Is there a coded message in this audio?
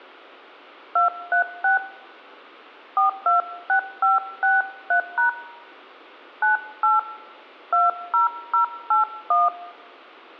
Yes: DTMF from 1.0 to 9.5 s, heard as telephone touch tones, dialled by hand, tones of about 140 ms. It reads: 236 426563# 98 20081